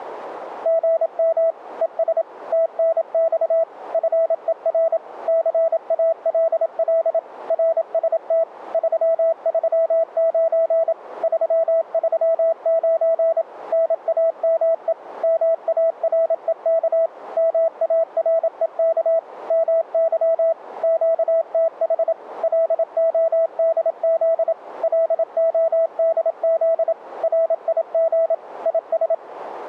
Morse code, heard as a keyed tone, machine-sent, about 27 wpm, 660 Hz. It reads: GM ES TNX FER CALL RST 339 339 NAME MAREK MAREK MY QTH LODZ LODZ RIG IS